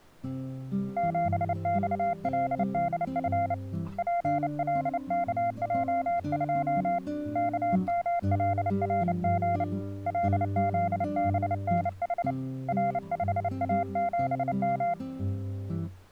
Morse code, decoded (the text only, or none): 7XLDF PLKJ2 KMLRG LZBNH R5A7M